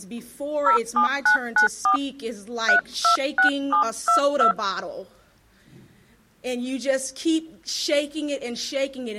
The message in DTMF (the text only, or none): 07994 326722